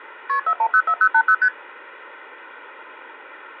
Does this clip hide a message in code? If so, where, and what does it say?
Yes: multi-frequency trunk signalling (R1, as on North American trunks) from 0.3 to 1.5 s, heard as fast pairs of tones, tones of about 70 ms. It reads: KP 4104080 ST